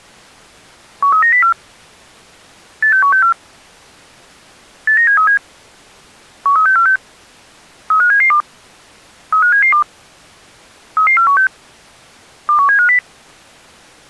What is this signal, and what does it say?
Five-tone selective call (CCIR), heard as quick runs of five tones, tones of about 100 ms. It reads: 13904 86164 89737 13646 35772 35772 33416 21750